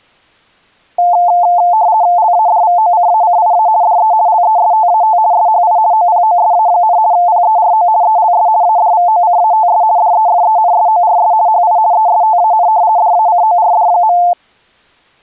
RTTY (50 baud, 170 Hz shift), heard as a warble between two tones, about 790 Hz centre. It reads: LADVOCACIA DE LESTAT SHI OPOSA, PERO ELS ADVOCATS DEFENSORS HI ESTAN DACORD.